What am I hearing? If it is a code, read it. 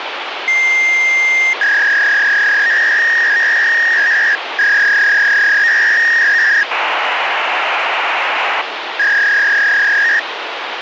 Fax machine handshake, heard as a long tone, a warble and hiss, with phone line noise.